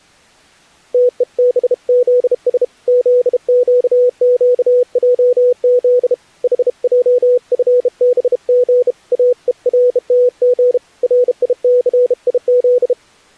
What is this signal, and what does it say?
Morse code, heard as a keyed tone, hand-sent with a bug key, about 32 wpm, 490 Hz. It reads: TEBZS ZQQJZ HJFBG AERTG RICIZ